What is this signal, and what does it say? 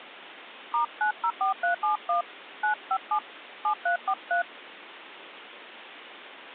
DTMF, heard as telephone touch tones, dialled by hand, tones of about 100 ms. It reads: *904371 957 7343